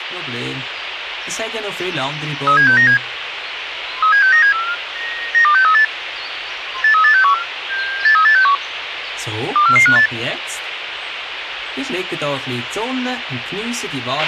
Five-tone selective call (CCIR), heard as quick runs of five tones, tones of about 100 ms, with radio hiss and a squelch burst at the end. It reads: 37697 37697 92638 83861 83861 24458